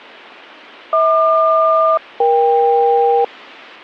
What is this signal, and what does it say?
Aircraft SELCAL, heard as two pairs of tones, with radio static. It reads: HQ-EK